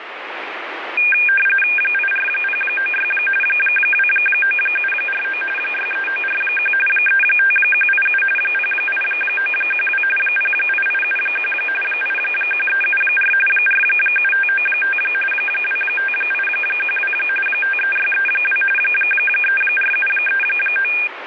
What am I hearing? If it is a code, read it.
RTTY (45.45 baud, 850 Hz shift), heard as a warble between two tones, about 2000 Hz centre, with radio static. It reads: 84096 29749 63941 35187 08912 08871 81374 47595 25812 53632 34739